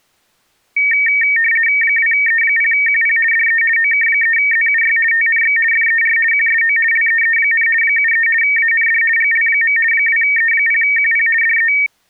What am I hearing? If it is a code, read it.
RTTY (50 baud, 450 Hz shift), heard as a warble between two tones, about 2050 Hz centre. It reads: 2E0QP DE OK3ZUY TNX FER QSO LEE, 73 AND GL. 2E0QP DE